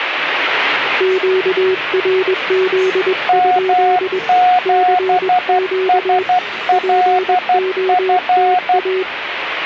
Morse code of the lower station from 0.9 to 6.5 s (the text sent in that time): QRZ? CQ